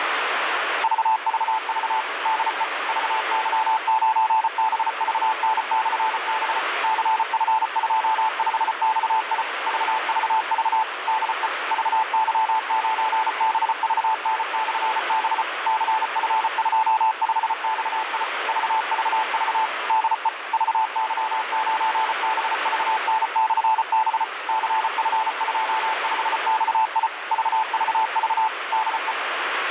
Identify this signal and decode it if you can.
Morse code, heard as a keyed tone, machine-sent, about 34 wpm, 880 Hz, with radio static. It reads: VVV DE VY9BVN/B CF25XI VVV DE VY9BVN/B CF25XI VVV DE VY9BVN/B CF25XI VVV DE